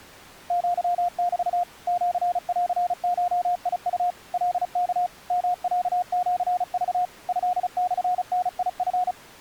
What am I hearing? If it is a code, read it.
Morse code (Japanese Wabun code), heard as a keyed tone, machine-sent, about 35 wpm, 720 Hz. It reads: アメ シンゴウ カワ ヨロシク トモダチ